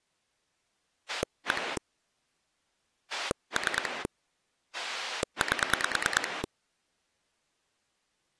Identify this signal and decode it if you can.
Pulse dialling, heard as a rotary dial, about 9 pulses a second. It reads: 1 3 8